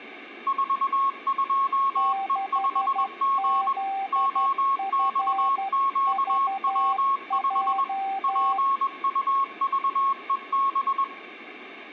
Morse code, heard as two keyed tones, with room echo. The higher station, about 21 wpm, 1090 Hz: 42E5G OXQW5 PUVEB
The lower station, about 12 wpm, 780 Hz: 6ZFVJ